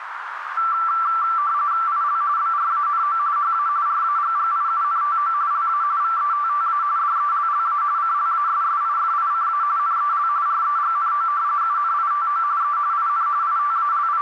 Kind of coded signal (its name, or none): RTTY